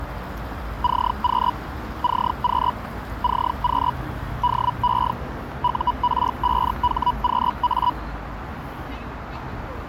Hellschreiber (Feld-Hell, 122.5 baud), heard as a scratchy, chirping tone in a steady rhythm, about 980 Hz, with radio static, a narrow filter and the noise of a residential street. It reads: CQ CQ CQ DE UR5HQA